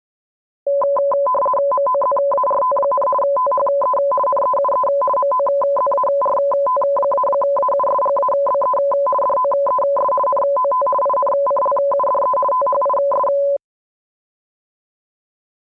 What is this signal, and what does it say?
RTTY (50 baud, 450 Hz shift), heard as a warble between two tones, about 790 Hz centre. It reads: MOZART, THE NEUE MOZART-AUSGABE DOES NOT INCLUDE THIS